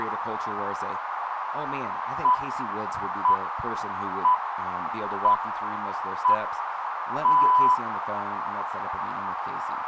Radio time signal (six pips, as the Greenwich Time Signal), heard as pips, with radio static and a narrow filter.